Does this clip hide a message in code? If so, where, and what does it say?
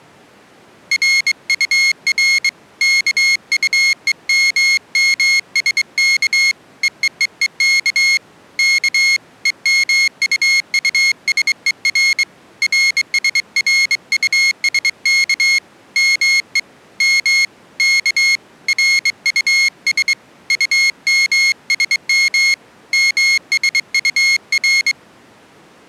Yes: Morse code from 0.9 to 25.0 s, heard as a high beeper, hand-sent with a straight key, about 23 wpm, 2150 Hz. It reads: RUR KUEMMSK EEEEK K EMUUSER RSRUSK ME M K RUS UMSM MSUR